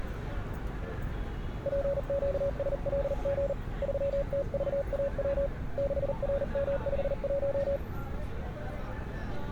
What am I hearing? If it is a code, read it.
Morse code, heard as a keyed tone, hand-sent with a paddle, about 39 wpm, 560 Hz, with street noise. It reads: PQSLG 3TVAW 6RM51